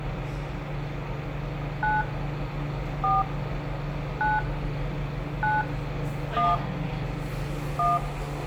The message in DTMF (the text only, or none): 9 4 9 9 1 1